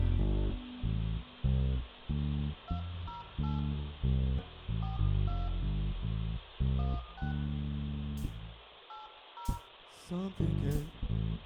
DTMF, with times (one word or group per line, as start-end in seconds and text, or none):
2.7-3.6 208
4.8-5.5 42
6.8-7.3 16
8.9-9.6 80